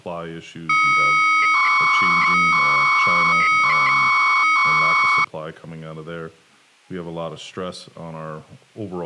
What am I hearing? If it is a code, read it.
300-baud modem data (Bell 103 tones), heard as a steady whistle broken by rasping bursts, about 300 baud, 200 Hz shift, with speech in English.